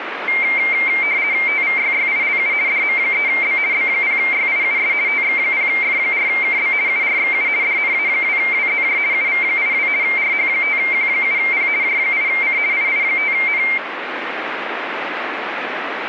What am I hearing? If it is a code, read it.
RTTY (50 baud, 170 Hz shift), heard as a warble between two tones, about 2200 Hz centre, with radio static. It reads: TVYYILU DM3B B0YIUS TX0F4KB URXU DNA2WZJ UV82 RH5Q7P J8C II5N